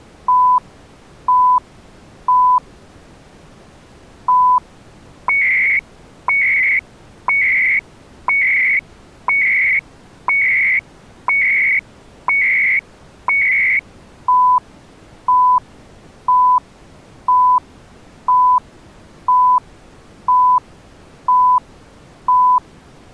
Radio time signal (CHU, Canada), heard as beeps and data bursts, one a second.